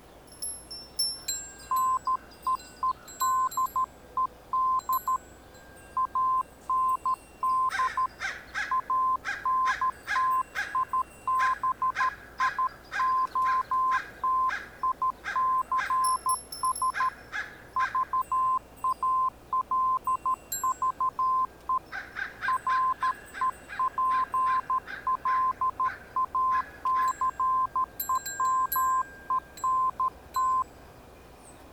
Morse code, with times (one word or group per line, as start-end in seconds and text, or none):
1.7-5.2 NEEDED
6.0-8.1 AND
8.7-17.1 ANTIBIOTICS
17.8-21.8 VALVE
22.5-30.6 REPLACEMENT